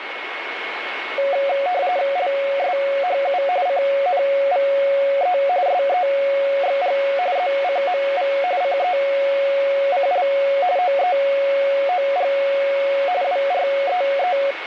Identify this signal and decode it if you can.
RTTY (45.45 baud, 170 Hz shift), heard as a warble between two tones, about 640 Hz centre, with radio static and a steady whistle near 2190 Hz. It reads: LSHU CNVE SEXG ZCMV CECL OEOG WREE